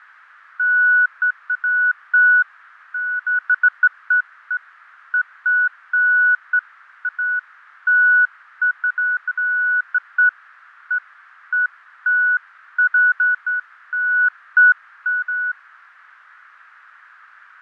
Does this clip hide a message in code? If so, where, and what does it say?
No, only beeps of irregular length, with radio static and fading.